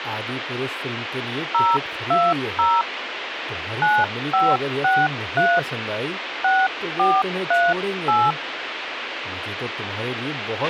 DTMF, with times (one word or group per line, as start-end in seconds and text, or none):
1.5-2.8 020
3.8-5.6 9563
6.4-8.3 6438